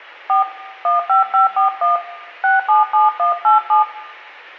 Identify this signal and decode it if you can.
DTMF, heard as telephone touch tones, dialled by hand, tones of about 140 ms, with room echo. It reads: 4 15541 677187